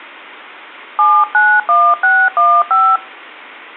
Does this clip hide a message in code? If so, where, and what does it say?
Yes: DTMF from 1.0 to 3.0 s, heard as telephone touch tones, dialled by hand, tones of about 250 ms. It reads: 791615